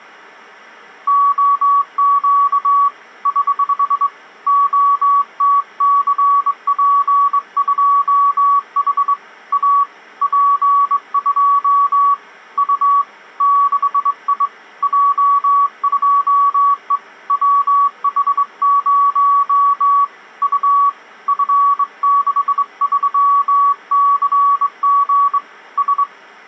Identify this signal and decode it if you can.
Morse code, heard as a keyed tone, hand-sent with a straight key, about 22 wpm, 1130 Hz. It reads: OQ <HH> OTCP2H A P2 U 6I J2E WH0 U F63CG S